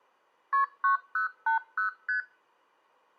Multi-frequency trunk signalling (R1, as on North American trunks), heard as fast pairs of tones, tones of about 120 ms. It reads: KP 9080 ST